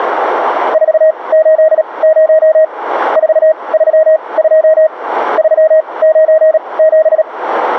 Morse code, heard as a keyed tone, machine-sent, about 37 wpm, spaced as for 25 wpm, 630 Hz. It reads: 480 432 397